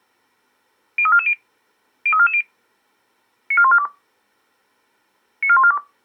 Five-tone selective call (ZVEI), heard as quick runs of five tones, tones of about 70 ms. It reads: 03440 03440 94142 94142